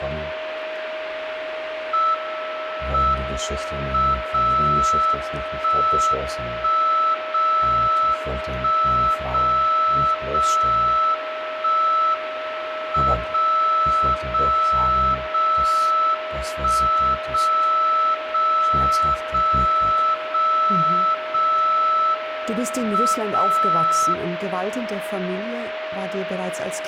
Radio time signal (WWVB), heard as a tone whose level steps once a second, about 1320 Hz, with radio static and a steady whistle near 630 Hz. The time is 10:39 UTC. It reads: M M 0 1 1 0 1 0 0 1 M 0 0 0 1 0 0 0 0 0 M 0